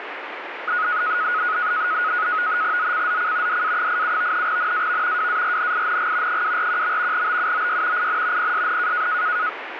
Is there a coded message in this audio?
Yes: NAVTEX (SITOR-B), 100 baud, 170 Hz shift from 0.7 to 9.5 s, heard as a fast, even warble, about 1360 Hz centre, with radio static. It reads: ZCZC DA87 NAV WARNING 241. BUOY IN PSN